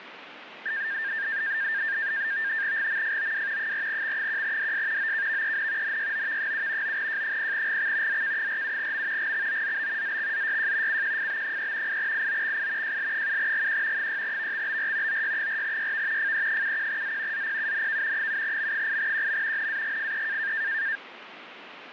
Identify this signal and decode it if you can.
NAVTEX (SITOR-B), 100 baud, 170 Hz shift, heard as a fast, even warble, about 1700 Hz centre, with radio static. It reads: GMFOW 4X1DS OKVEN NYOV7 9J0GX ZK47M GXOZB ZXZYJ CQFB3 8IOXI JL7GQ 6VXBR OY4YV FE71Z ZPUNK 7M8QM NAGFE